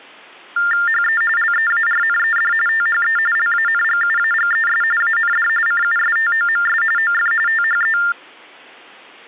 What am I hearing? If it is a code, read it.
TTY/TDD text telephone tones (45.45 baud Baudot), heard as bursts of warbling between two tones, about 400 Hz shift, 1600 Hz centre. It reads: HE LEARNED THE LANGUAGES AND CUSTOMS OF THE